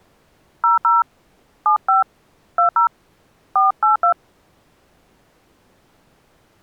DTMF, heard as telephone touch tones, dialled by hand, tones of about 130 ms. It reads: 00 75 20 482